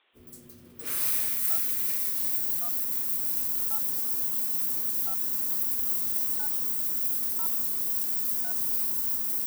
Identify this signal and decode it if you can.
DTMF, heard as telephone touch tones, dialled by hand, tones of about 80 ms, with the noise of a restroom. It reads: 2 1 8 5 9 0 3